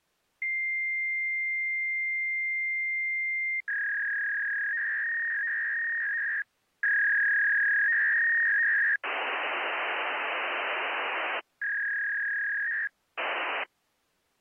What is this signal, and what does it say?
Fax machine handshake, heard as a long tone, a warble and hiss.